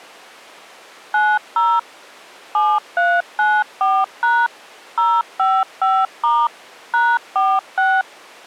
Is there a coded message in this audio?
Yes: DTMF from 1.1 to 8.0 s, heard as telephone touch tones, dialled by machine, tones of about 240 ms. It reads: 90 7394# 055* #46